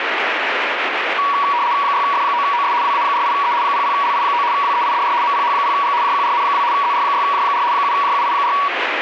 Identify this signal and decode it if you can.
RTTY (75 baud, 170 Hz shift), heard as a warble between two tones, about 1040 Hz centre, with radio static. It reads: 6F9OS WA48E 00LI9 WEIDR MPH0G JQRN2 ZR6J4 7JUI4